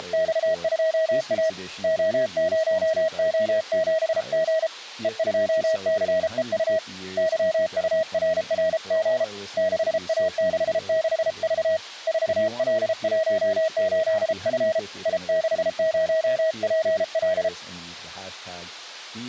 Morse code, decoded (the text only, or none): … O0O7G E2CEU YURRG 6A66V 4L18F I60PL